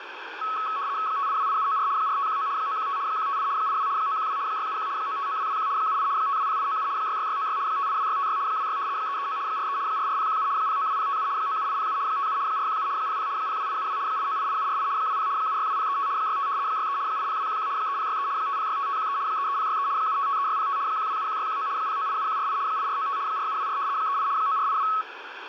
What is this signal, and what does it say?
RTTY (75 baud, 170 Hz shift), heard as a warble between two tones, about 1200 Hz centre, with radio static. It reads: 5828794 4519 915 158 82 912 671 959221 78 520897 66696 582656 26 339 43 44017 092057 97807 57 417 00 02872 8988748 20 762035 65 63 80211 3063 5065513 33063 7553605 1271619 0987148 8495 4724 38 9482